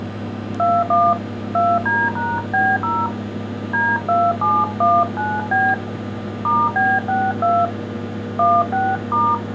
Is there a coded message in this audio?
Yes: DTMF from 0.6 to 9.3 s, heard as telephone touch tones, dialled by hand, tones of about 230 ms, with kitchen noise. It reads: 21 2D#B0 D2719B *B62 16*